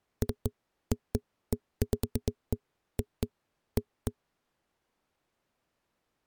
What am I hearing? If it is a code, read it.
Irregular knocks on a wall. There is no code.